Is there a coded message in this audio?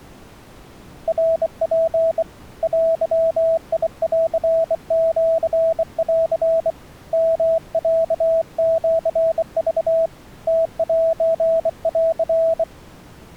Yes: Morse code (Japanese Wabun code) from 1.0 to 12.7 s, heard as a keyed tone, hand-sent with a bug key, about 24 wpm, 660 Hz. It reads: ナツ デンシン ヨロシク ムセン